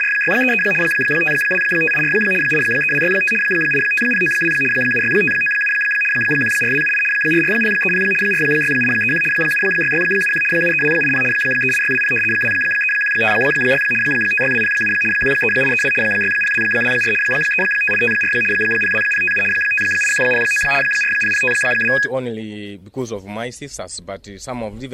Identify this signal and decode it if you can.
RTTY (75 baud, 850 Hz shift), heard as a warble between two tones, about 2100 Hz centre. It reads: … 52584 83265 85092 76597 14278 44030 46831 76671 73280 38620 23156 56207 13832 60224 35854 02057 58109 40052